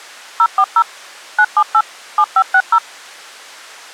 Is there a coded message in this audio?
Yes: DTMF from 0.4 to 2.8 s, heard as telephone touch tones, dialled by machine, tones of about 60 ms. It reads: 040 978 7560